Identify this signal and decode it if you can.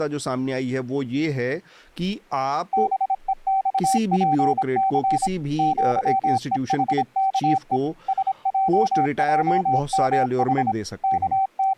Morse code (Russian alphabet), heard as a keyed tone, machine-sent, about 26 wpm, 770 Hz, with speech in Hindi. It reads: БЕЬПЦ ЪЕХКЕ СЙЙМХ …